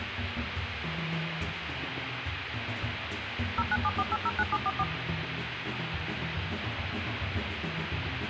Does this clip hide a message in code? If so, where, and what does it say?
Yes: DTMF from 3.6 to 4.8 s, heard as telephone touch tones, dialled by machine, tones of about 40 ms, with phone line noise. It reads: 0974809744